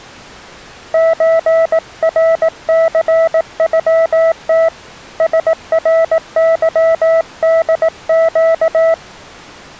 Morse code (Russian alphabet), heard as a keyed tone, hand-sent with a paddle, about 18 wpm, 660 Hz. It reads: ЧРЦЮТ СРЫДЩ